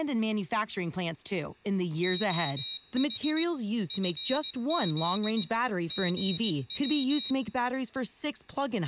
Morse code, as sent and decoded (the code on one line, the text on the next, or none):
--- .... / ..-. --.. / --. .--
OH FZ GW